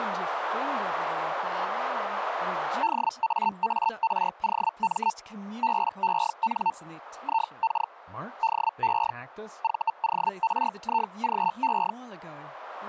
Hellschreiber (Feld-Hell, 122.5 baud), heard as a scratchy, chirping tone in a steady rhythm, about 900 Hz, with speech in English. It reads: DAAROM BEN IK DE VORIGE